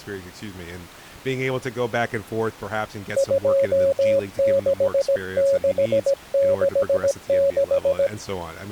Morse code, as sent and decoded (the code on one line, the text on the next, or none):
..--- -.... -.... -.... -....
26666